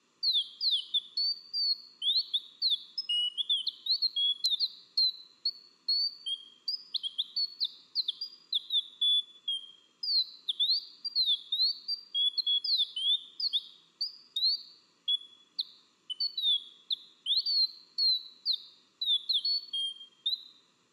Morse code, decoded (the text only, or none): none